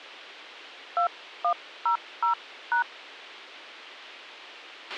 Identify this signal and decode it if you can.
DTMF, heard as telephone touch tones, dialled by hand, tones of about 100 ms, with a squelch burst at the end. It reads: 2100#